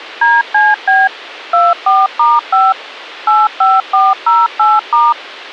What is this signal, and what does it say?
DTMF, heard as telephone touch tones, dialled by machine, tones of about 200 ms. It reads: DCB 24*5 85408*